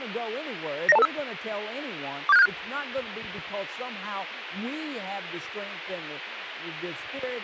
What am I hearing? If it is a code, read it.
Five-tone selective call (EIA), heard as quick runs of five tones, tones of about 30 ms. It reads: 90225 47676